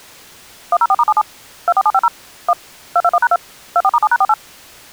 DTMF, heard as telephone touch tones, dialled by machine, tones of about 50 ms. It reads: 104*77 24750 1 221#2 24*7#48